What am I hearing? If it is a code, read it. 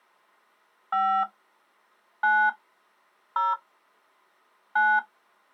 DTMF, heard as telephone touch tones, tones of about 250 ms. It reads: 5 9 0 9